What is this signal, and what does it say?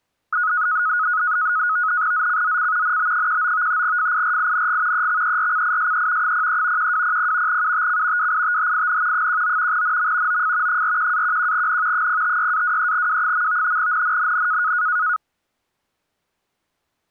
NAVTEX (SITOR-B), 100 baud, 170 Hz shift, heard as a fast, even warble, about 1360 Hz centre. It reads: ZCZC NB19 FIRING EXERCISE 03 1200 UTC WITHIN 19 NM OF 41-11N 056-23W. NNNN